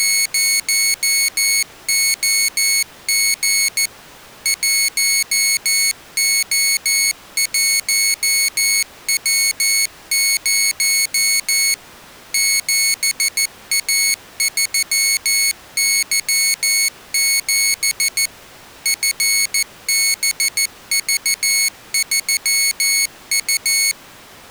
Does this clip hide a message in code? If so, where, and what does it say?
Yes: Morse code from 0.0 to 24.0 s, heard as a high beeper, machine-sent, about 14 wpm, 2200 Hz. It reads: … 1O1W0 7A3Y7 FBV3U